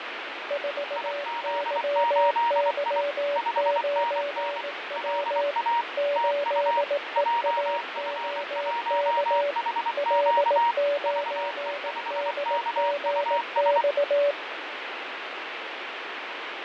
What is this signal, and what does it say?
Morse code, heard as two keyed tones, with radio static and fading. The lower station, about 18 wpm, 570 Hz: 4YY9W 8EAOK L9DGX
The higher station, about 24 wpm, 940 Hz: IZ8I 5NN LA TU JF1HQ VE5KUS